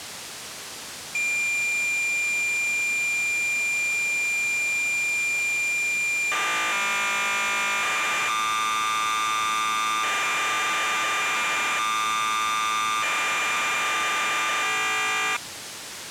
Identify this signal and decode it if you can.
Cassette data (Kansas City type), 1200 baud, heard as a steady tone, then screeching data, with tape hiss.